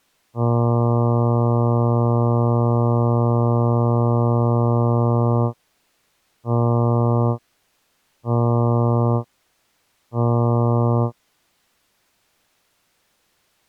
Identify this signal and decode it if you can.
Ship horn signal, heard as a ship's horn, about 120 Hz. 1 long, 3 short. At sea: a vessel under tow in fog.